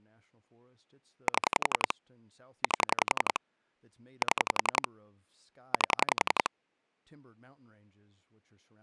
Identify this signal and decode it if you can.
Pulse dialling, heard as clicks on a phone line, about 11 pulses a second, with speech in English. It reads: 7 8 7 8